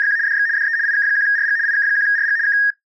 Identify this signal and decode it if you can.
RTTY (75 baud, 170 Hz shift), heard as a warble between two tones, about 1750 Hz centre. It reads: … DX DE IK1RG IK1RG K